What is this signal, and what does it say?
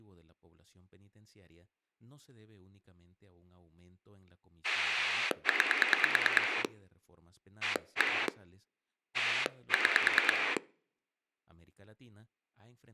Pulse dialling, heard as a rotary dial, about 9 pulses a second, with speech in Spanish. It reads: 9 1 6